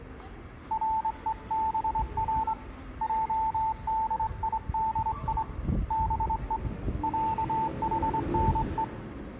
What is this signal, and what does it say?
Morse code (Persian alphabet), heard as a keyed tone, hand-sent with a straight key, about 24 wpm, 890 Hz, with room echo and the noise of a residential street. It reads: رهبر جدیدی به صحنه